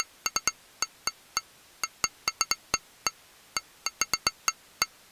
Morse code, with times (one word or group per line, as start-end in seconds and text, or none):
none